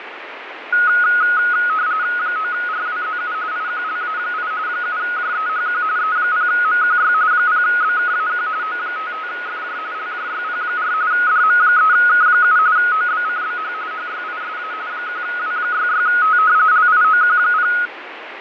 RTTY (45.45 baud, 170 Hz shift), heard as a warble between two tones, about 1360 Hz centre, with radio static and fading. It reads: 9RWZU IQLA8 7JEHQ E0MQY 0BKAQ O55FJ LJYP4 DM3K7 OBCBH HYISA 1W66T LIOQ0